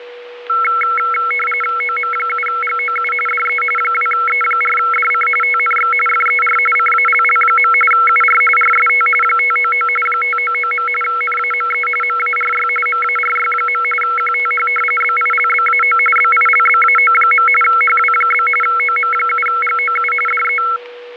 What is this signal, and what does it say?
RTTY (45.45 baud, 850 Hz shift), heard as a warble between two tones, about 1750 Hz centre, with radio static and a steady whistle near 490 Hz. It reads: OM7GOU DE 2E4DC TNX FER CALL. UR RST 599 599. NAME MARY MARY. QTH BILBAO BILBAO. HW? OM7GOU DE